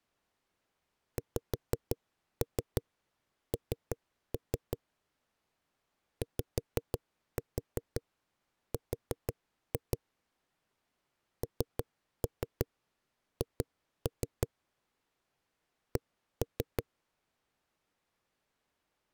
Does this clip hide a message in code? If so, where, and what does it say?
Yes: tap code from 1.2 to 16.8 s, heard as knocks on a wall, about 6 knocks a second. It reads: XN YR NH C